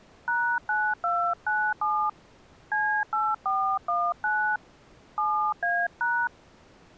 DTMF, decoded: #9297 C8419 7A#

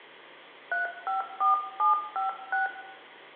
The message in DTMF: 354756

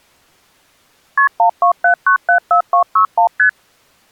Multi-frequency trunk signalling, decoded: KP 127974261 ST

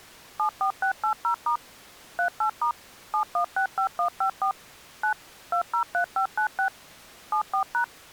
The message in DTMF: 74680* 38* 7165154 9 203596 74#

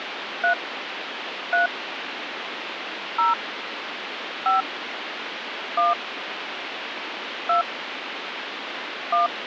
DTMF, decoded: 3 3 0 5 1 2 1

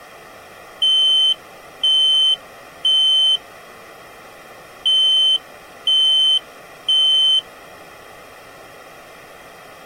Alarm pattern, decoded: temporal three

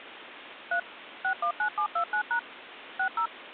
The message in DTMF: 3 619729# 60

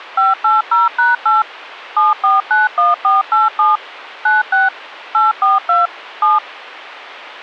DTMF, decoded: 580#8 7491487 96 842 7

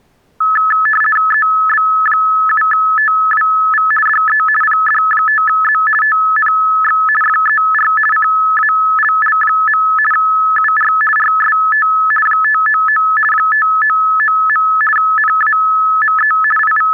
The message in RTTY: EB7TWV DE PD5Z TNX FER CALL. UR RST 599 599. NAME …

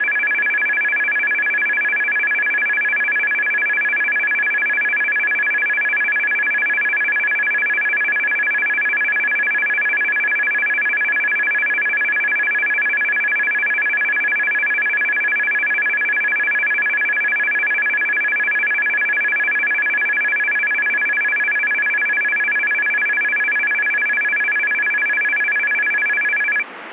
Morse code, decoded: none

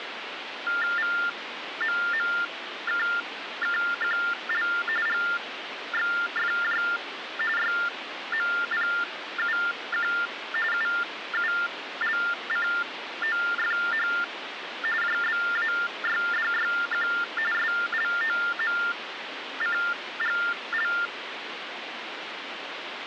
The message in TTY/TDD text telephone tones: VMMKKQL GXFJ YMPUQ UULCOFH JBAYDYQ SLOMCGL

